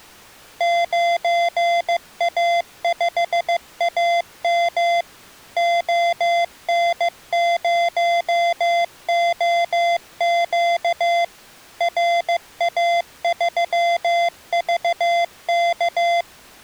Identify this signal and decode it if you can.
Morse code, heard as electronic beeps, machine-sent, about 15 wpm, 690 Hz. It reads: 9A5AM ON0OQ RA3VK